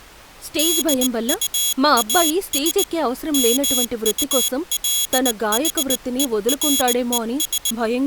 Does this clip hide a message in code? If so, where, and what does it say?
Yes: Morse code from 0.5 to 7.8 s, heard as a high beeper, hand-sent with a bug key, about 19 wpm, 3350 Hz, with speech in Telugu. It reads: DUAS MULHERES